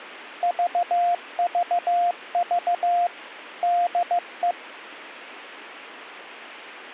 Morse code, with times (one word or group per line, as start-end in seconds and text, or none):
0.4-3.1 VVV
3.6-4.5 DE